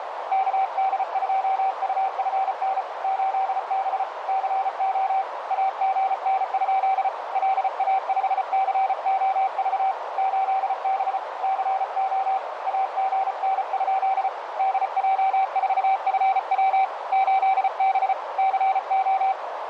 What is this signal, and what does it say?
Morse code, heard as a keyed tone, hand-sent with a paddle, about 34 wpm, 770 Hz, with radio static and a narrow filter. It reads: KD2UFN 8B CO AGN? LA5COV 8B CO AGN? DJ4FW 8B CO